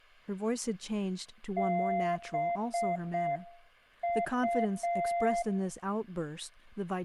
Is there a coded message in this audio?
Yes: Morse code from 1.5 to 5.5 s, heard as a keyed tone, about 6 wpm, 690 Hz, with speech in English. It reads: BU